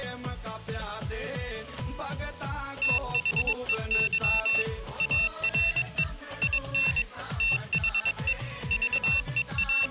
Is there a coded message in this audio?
Yes: Morse code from 2.8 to 9.9 s, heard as a high beeper, machine-sent, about 22 wpm, 2700 Hz. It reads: THEY ARE IN THE …